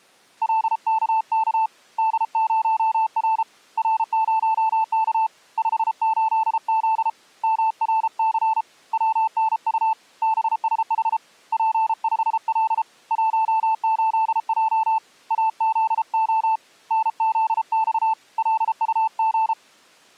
Morse code, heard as a keyed tone, hand-sent with a paddle, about 33 wpm, 880 Hz. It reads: LKK D0R R0K 58Z MRC WNU BSH P5L 18J AZO NZX LUG